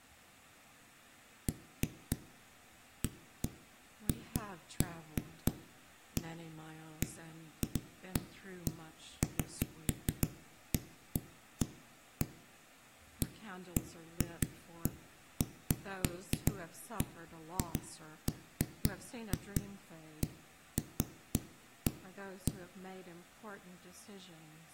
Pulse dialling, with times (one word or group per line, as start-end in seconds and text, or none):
none